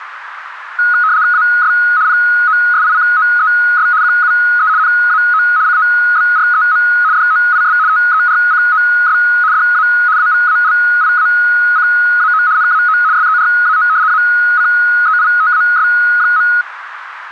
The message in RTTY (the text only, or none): AS POSICOES QUE NAO COBREM DOIS TERCOS DA AVALIACAO NAO SERAO ACEITAS.